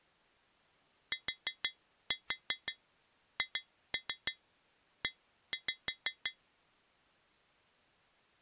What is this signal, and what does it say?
Tap code, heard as taps on glass, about 6 knocks a second. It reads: THE